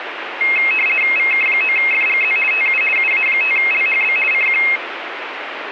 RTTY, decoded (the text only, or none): VK9FGZ TU UA5LHB CQ